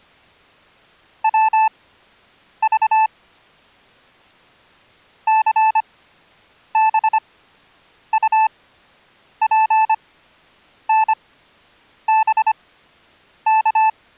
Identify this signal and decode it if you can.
Morse code, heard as a keyed tone, machine-sent, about 25 wpm, spaced as for 8 wpm, 880 Hz. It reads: WV CBUPNBK